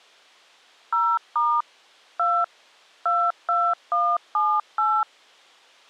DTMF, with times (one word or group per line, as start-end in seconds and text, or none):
0.9-1.6 0*
2.2-2.4 2
3.1-5.0 22178